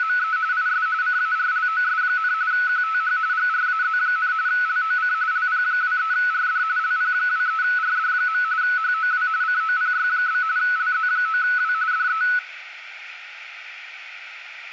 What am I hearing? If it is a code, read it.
RTTY (45.45 baud, 170 Hz shift), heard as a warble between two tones, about 1390 Hz centre, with radio static and room echo. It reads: … IS CARLOS, QTH GRAZ, LOC LP23RD LP23RD. HOW COPY? LZ9W DE